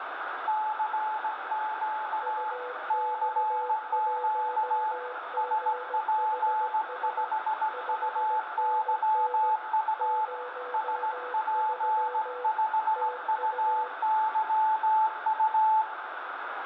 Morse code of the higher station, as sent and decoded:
-.-. --.- / -.-. --.- / ... .--. ..... ..- -.-- ..- / ... .--. ..... ..- -.-- ..-
CQ CQ SP5UYU SP5UYU

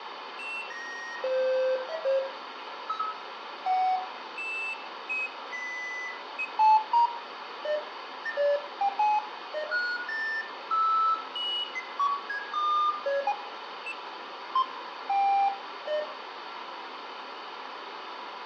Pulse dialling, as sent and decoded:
none

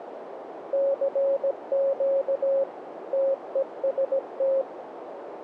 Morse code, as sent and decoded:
-.-. --.- / - . ... -
CQ TEST

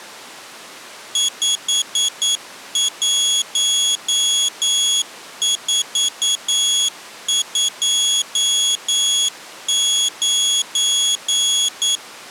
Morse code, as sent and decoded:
..... .---- ....- ..--- ----.
51429

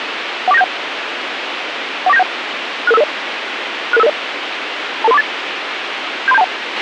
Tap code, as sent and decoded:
none

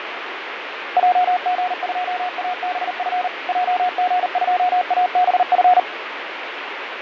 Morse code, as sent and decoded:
.--- --. ..--- .- -... ..-. / .--- --. ..--- .- -... ..-.
JG2ABF JG2ABF

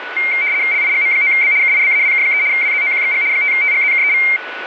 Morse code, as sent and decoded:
none

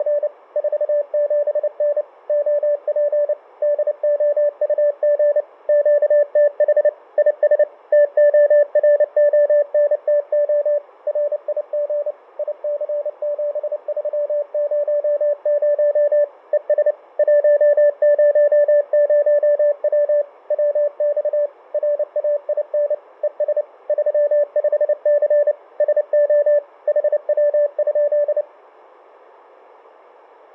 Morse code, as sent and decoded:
… / ....- --... -. / --- .--. / -.. --- ..- --. / --.- - .... / .. ... / - --- .-. --- -. - --- / .-. .. --. / .. -.-. --... ...-- ----- ----- / . ... / .---- ----- ----- .-- / .-- -..- / .-. .- .. -. / . ... / ...-- ..... -.-. / ... --- / .... .-- ..--..
… 47N OP DOUG QTH IS TORONTO RIG IC7300 ES 100W WX RAIN ES 35C SO HW?

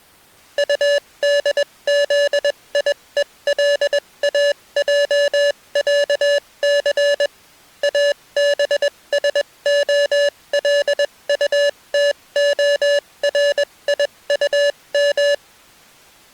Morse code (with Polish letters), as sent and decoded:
..- -.. --.. .. . .-.. .- .--- .-.- -.-. / .- -... ... --- .-.. ..- - --- .-. .. ..- --
UDZIELAJĄC ABSOLUTORIUM

